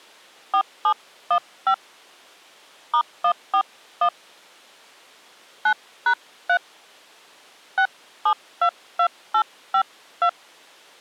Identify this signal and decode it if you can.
DTMF, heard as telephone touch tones, dialled by hand, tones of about 80 ms. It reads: 4715 *141 9#3 6722852